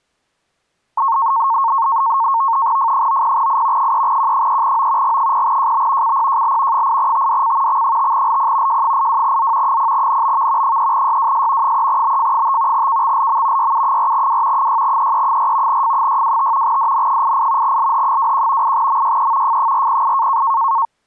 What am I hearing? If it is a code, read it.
NAVTEX (SITOR-B), 100 baud, 170 Hz shift, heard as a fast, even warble, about 1000 Hz centre. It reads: F90I 3Q3O G0JB CPJL 8TDC X5LP J82Z 0NBV 3YWS 3BF5 KXLM YU4W 6EE4 F625 DN88 LH21 8MYE F408